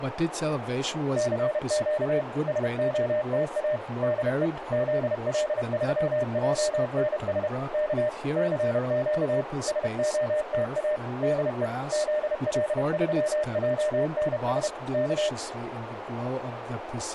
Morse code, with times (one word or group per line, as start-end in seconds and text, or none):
1.2-2.2 CQ
2.5-3.8 SOTA
4.0-4.5 DE
4.7-7.5 ZL3JNS
7.7-8.1 K
8.4-9.4 CQ
9.7-11.0 SOTA
11.2-11.7 DE
11.9-14.7 ZL3JNS
14.9-15.3 K